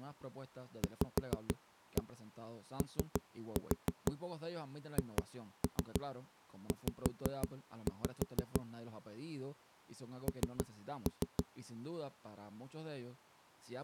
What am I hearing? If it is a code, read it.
Tap code, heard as knocks on a wall, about 6 knocks a second, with speech in Spanish. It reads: VOHZ N